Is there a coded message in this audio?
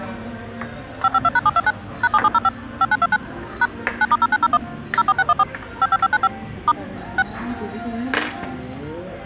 Yes: DTMF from 1.0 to 7.2 s, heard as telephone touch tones, dialled by machine, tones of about 40 ms, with the noise of a restaurant. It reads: 552#729 #7705 5929 # 9*0901 04614 55595 * 6